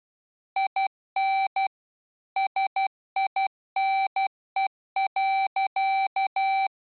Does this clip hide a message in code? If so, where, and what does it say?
Yes: Morse code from 0.5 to 6.7 s, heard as electronic beeps, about 12 wpm, 780 Hz. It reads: IN SINE.